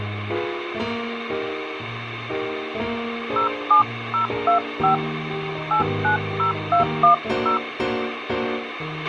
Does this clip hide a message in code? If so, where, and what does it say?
Yes: DTMF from 3.4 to 7.6 s, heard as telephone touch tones, dialled by hand, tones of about 120 ms, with radio hiss and a squelch burst at the end. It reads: 07025 890210